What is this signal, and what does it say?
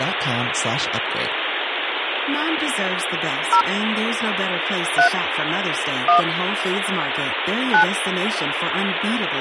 DTMF, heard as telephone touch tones, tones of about 100 ms, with phone line noise and speech in Danish. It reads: 0 3 1 9